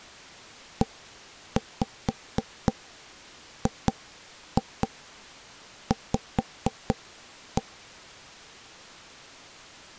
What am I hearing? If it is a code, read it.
Tap code, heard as knocks on wood, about 4 knocks a second. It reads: EGV